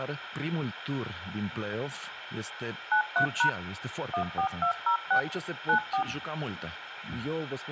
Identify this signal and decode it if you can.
DTMF, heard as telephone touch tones, dialled by machine, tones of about 100 ms, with radio hiss. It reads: 93# 14206 94